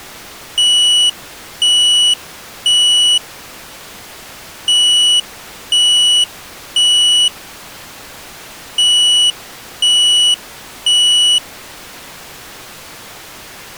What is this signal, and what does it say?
Alarm pattern, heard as an alarm's beeps, played three times, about 2950 Hz. Temporal three. Smoke or fire, evacuate.